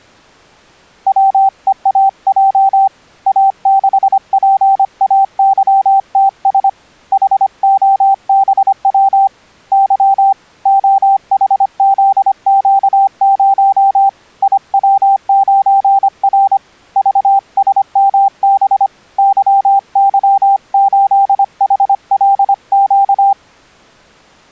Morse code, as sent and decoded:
.-- . .- .--- / .- -.... .--. .- -.-- - ... / .... --- -... .-- / -.-- / --- .... --.. --.- ----- / .. .-- ----. .-. / ...- ... -- -... / -.-- -.-- ---.. .... .-.. --.-
WEAJ A6PAYTS HOBW Y OHZQ0 IW9R VSMB YY8HLQ

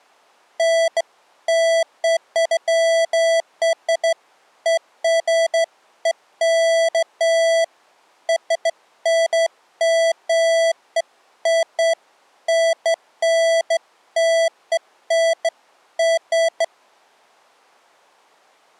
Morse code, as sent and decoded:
none

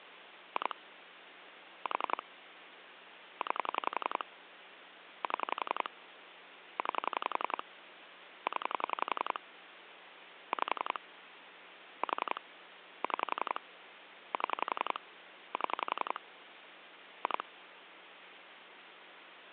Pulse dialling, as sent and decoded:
2 / 4 / 9 / 7 / 9 / 10 / 5 / 4 / 6 / 7 / 7 / 2
2 4 9 7 9 0 5 4 6 7 7 2

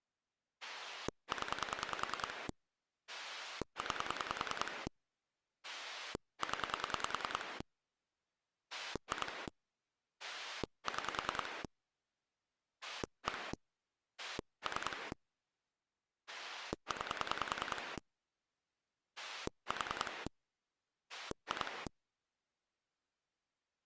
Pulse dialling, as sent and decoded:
10 / 9 / 10 / 2 / 6 / 1 / 3 / 9 / 4 / 2
0 9 0 2 6 1 3 9 4 2

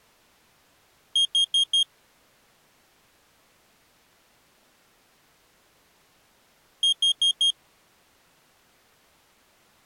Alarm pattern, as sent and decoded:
4 beeps and a pause
temporal four

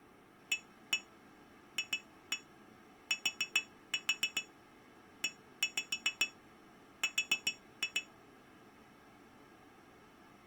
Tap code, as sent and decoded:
1-1 2-1 4-4 1-5 4-2
AFTER

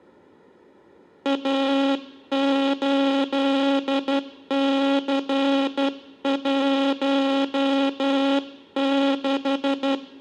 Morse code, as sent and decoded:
.- ---.. -.-. .---- -....
A8C16

